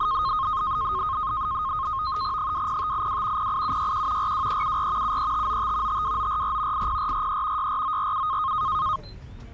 NAVTEX (SITOR-B), 100 baud, 170 Hz shift, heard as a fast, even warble, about 1160 Hz centre, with the noise inside a bus. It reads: 20582 08761 42374 73595 52944 80443 64947